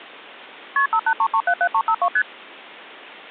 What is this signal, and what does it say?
Multi-frequency trunk signalling (R1, as on North American trunks), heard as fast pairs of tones, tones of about 70 ms. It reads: KP 583377352 ST